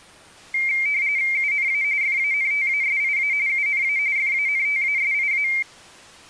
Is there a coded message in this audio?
Yes: RTTY (45.45 baud, 170 Hz shift) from 0.5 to 5.6 s, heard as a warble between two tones, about 2200 Hz centre. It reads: UNA FANTASIA UNA FANTASIA